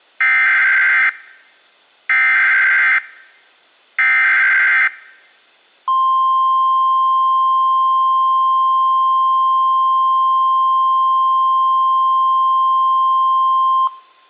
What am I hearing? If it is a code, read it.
Emergency Alert System (SAME) tones (header bursts, then the 1050 Hz attention tone), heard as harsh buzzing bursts, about 520.83 baud.